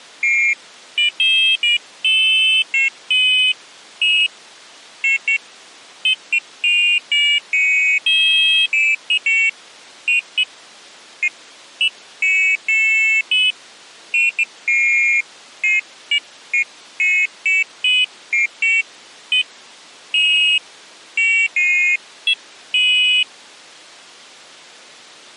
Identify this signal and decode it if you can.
Pairs of high tones at irregular times. There is no code.